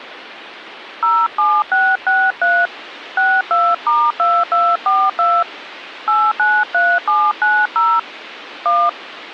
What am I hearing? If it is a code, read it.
DTMF, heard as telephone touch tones, dialled by hand, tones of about 240 ms, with phone line noise. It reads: 07663 62*2242 893790 1